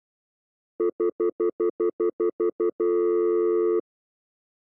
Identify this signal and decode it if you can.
Telephone call progress tone (North American plan), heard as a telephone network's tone, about 350, 440 Hz, 0.1 s on and 0.1 s off. Stutter dial tone.